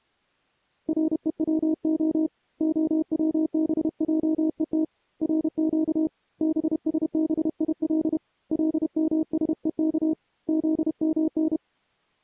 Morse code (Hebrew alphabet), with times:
0.9-2.3 רוצה
2.6-4.8 הצבעות
5.2-6.1 רק
6.4-8.2 בשביל
8.5-10.1 למשוך
10.5-11.6 זמן

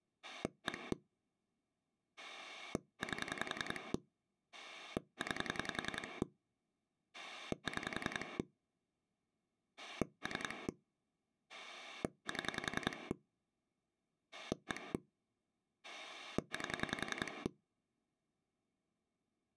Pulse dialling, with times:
0.2-0.9 1
2.2-3.9 8
4.5-6.2 9
7.1-8.4 6
9.8-10.7 3
11.5-13.1 7
14.3-14.9 1
15.8-17.5 8

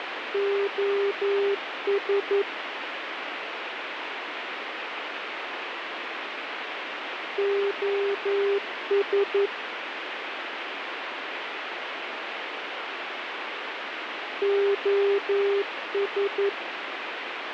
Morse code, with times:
0.3-2.4 OS
7.4-9.5 OS
14.4-16.5 OS

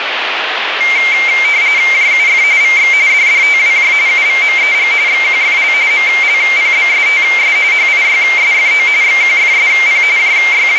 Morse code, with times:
none

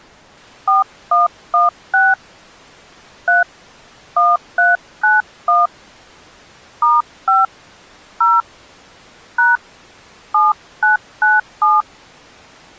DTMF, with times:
0.7-2.1 4116
3.3-3.4 3
4.2-5.7 1391
6.8-7.5 *5
8.2-8.4 0
9.4-9.6 #
10.3-11.8 7997

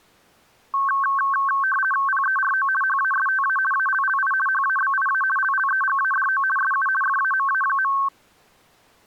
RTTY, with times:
2.1-2.7 PERO
2.8-3.6 HASTA
3.7-4.3 ALLI
4.5-5.2 HABIA
5.4-6.4 LLEGADO
6.6-6.9 SU
7.0-7.9 FAMA.

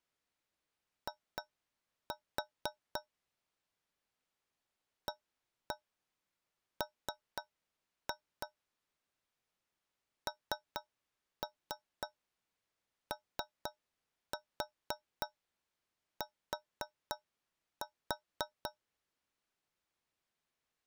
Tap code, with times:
1.1-3.0 I
5.1-8.5 AM
10.3-18.7 NOT

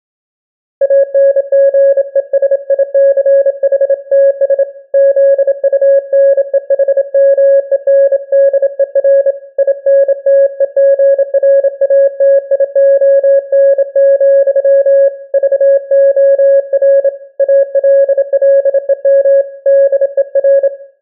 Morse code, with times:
0.8-4.6 ANGESICHTS
4.9-9.3 ZUNEHMENDER
9.6-15.1 INTEGRATION,
15.3-17.1 VOR
17.4-19.4 ALLEM
19.7-20.7 DER

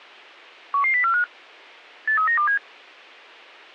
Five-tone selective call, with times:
0.7-1.2 11045
2.1-2.6 83927

